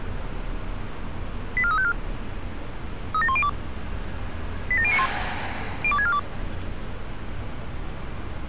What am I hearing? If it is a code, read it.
Five-tone selective call (ZVEI), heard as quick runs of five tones, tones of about 70 ms, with street noise. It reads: 84354 37102 87091 02642